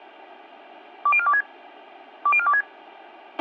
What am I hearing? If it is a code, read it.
Five-tone selective call (ZVEI), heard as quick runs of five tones, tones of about 70 ms, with a squelch burst at the end. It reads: 20426 20426